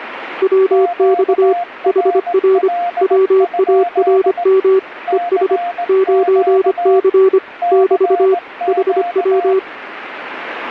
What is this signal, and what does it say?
Morse code, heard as two keyed tones, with radio static. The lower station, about 25 wpm, 380 Hz: WX HR WARM ES 9C <BT> HW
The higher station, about 18 wpm, 700 Hz: QRL? CQ CQ